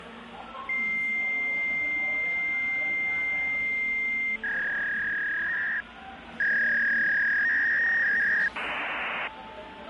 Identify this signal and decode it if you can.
Fax machine handshake, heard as a long tone, a warble and hiss, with phone line noise and the noise of a crowd indoors.